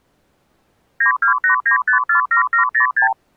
Multi-frequency trunk signalling (R2, with the far end's replies), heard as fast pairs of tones, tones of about 110 ms. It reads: 9289547706